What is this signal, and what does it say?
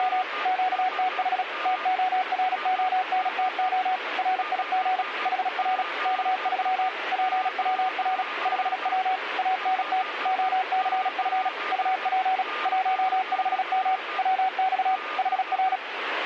Morse code, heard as a keyed tone, machine-sent, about 36 wpm, 750 Hz, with radio static and a weaker station near 1210 Hz. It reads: … QTH TORONTO RIG HR K3 PWR 5W ANT OCF UP 15M WX HR